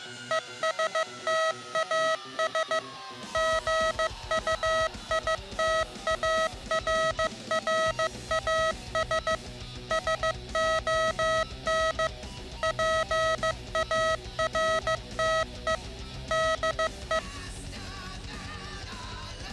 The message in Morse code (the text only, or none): ESTAS GUITARRAS SON PARTE DE